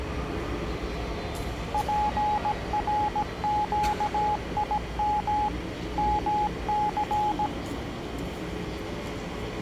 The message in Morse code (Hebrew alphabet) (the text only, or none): פרקים מס